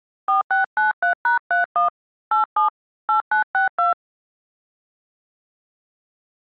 DTMF, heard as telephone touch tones, dialled by hand, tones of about 130 ms. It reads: 4693#31 87 8962